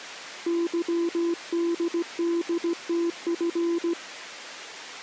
Morse code, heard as a keyed tone, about 17 wpm, 340 Hz. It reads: YDDTF